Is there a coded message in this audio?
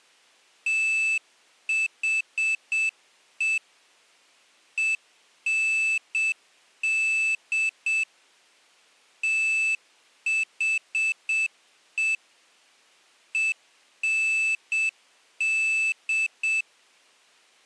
Yes: Morse code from 0.6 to 16.7 s, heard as a high beeper, machine-sent, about 7 wpm, 2650 Hz. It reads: THE END THE END